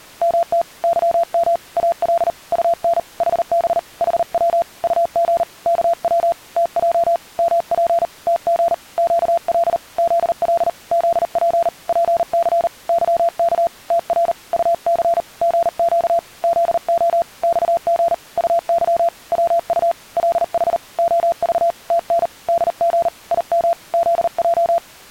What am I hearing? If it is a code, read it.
Morse code, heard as a keyed tone, hand-sent with a paddle, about 39 wpm, 680 Hz. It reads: MT YM AL UN HB HW UG KW TJ MP TG QL ZL ZP PC YK TR UC GQ ZO XG UY WU LH OV TN DG IM ZJ